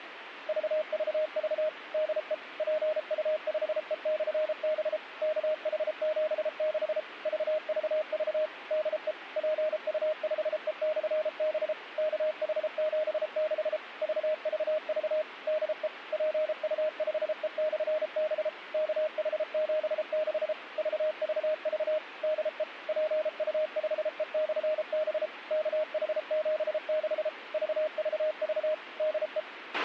Morse code, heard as a keyed tone, machine-sent, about 33 wpm, 620 Hz, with radio hiss and a squelch burst at the end. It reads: VVV DE PU5E/B KH76 VVV DE PU5E/B KH76 VVV DE PU5E/B KH76 VVV DE PU5E/B KH76 VVV DE